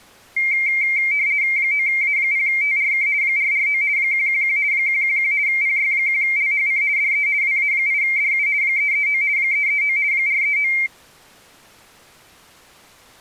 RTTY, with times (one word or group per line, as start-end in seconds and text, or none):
1.6-3.1 9A0TRK
3.2-3.8 449
4.0-4.6 111
4.7-5.3 111
5.5-6.8 PY1LHC
7.0-7.3 DE
7.4-8.5 WA8DU
8.6-9.2 339
9.4-10.0 339
10.1-10.7 439